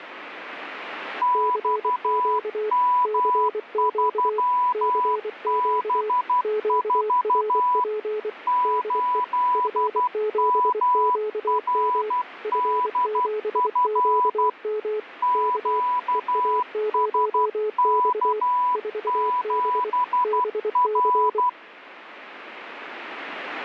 Morse code, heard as two keyed tones, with radio static. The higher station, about 12 wpm, 990 Hz: XM3B4 8MRDF QSK7R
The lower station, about 24 wpm, 430 Hz: CQ CQ CQ QRP DE F7QM F7QM K EA0X 4B BC